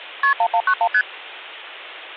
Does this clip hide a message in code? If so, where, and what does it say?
Yes: multi-frequency trunk signalling (R1, as on North American trunks) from 0.2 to 1.0 s, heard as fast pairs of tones, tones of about 70 ms. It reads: KP 1191 ST